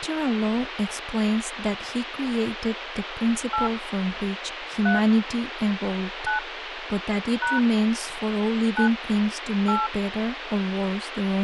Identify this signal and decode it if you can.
DTMF, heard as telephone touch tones, dialled by hand, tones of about 150 ms, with phone line noise and speech in English. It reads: 8 3 9 # 9 8